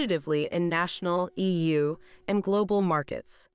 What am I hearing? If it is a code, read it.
Speech in English. There is no code.